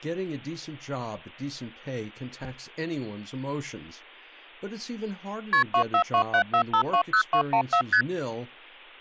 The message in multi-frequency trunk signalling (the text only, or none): KP 24274520214 ST